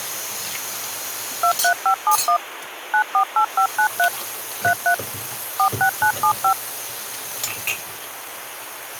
DTMF, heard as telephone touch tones, dialled by machine, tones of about 90 ms, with phone line noise and kitchen noise. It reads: 23571 948593 33 46975